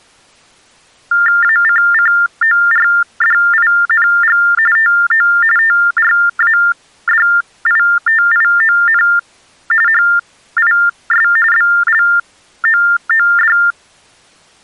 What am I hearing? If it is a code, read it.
TTY/TDD text telephone tones (45.45 baud Baudot), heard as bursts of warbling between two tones, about 400 Hz shift, 1600 Hz centre. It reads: ACCORDING TO TRADITION HIS BLOOD